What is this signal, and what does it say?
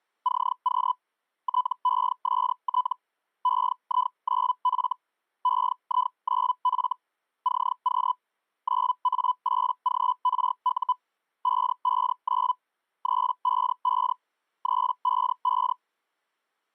Hellschreiber (Feld-Hell, 122.5 baud), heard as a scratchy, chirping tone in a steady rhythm, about 1000 Hz. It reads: CQ TEST EI9F EI9F CQ 9A8GRU 559 355 355